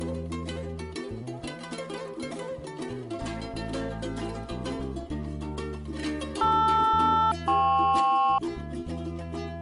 Aircraft SELCAL, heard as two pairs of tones. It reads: LR-KP